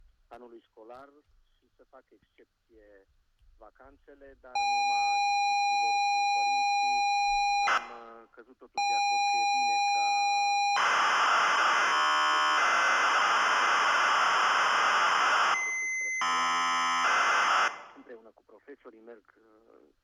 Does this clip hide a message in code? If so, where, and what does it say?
Yes: ZX Spectrum tape loading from 4.6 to 17.7 s, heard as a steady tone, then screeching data, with room echo.